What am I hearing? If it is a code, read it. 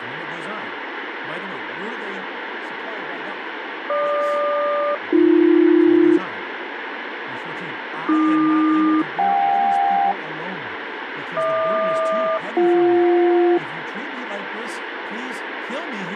Aircraft SELCAL, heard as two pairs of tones, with radio static and speech in English. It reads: GQ-AB AQ-JK HQ-BJ